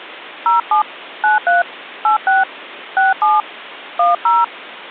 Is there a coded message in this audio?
Yes: DTMF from 0.5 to 4.4 s, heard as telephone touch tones, dialled by hand, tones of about 160 ms. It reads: 07 93 86 67 10